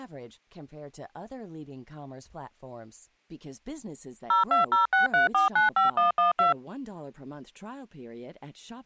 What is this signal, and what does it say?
DTMF, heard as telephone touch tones, dialled by machine, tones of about 140 ms, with speech in French. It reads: 02063495112